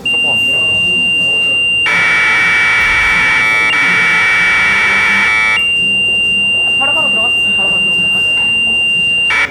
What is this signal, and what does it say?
Commodore tape loading (standard loader), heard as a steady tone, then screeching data, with room echo and the noise of a cafe.